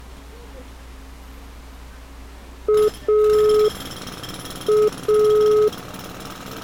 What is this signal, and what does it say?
Telephone call progress tone (pulsed, as in Italy), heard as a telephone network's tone, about 420 Hz, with street noise. Dial tone.